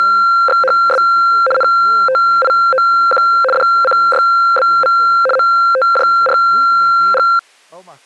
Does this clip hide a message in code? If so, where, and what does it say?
Yes: RTTY (75 baud, 850 Hz shift) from 0.0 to 7.4 s, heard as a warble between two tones, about 950 Hz centre, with speech in Portuguese. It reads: … NTIOQ DCYBV MTJRG